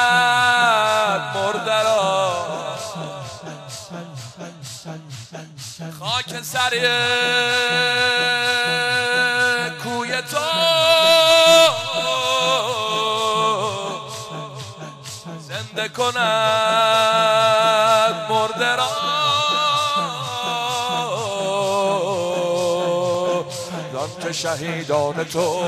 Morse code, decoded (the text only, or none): none